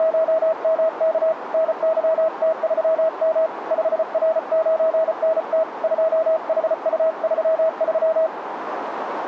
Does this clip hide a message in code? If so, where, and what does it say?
Yes: Morse code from 0.0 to 8.3 s, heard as a keyed tone, hand-sent with a paddle, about 34 wpm, 640 Hz, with radio static and a narrow filter. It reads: … NYT3M 5R9NT 2HU33